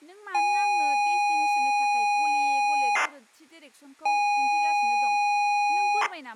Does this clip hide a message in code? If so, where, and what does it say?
Yes: ZX Spectrum tape loading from 0.3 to 6.1 s, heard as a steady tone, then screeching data, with speech in Bodo.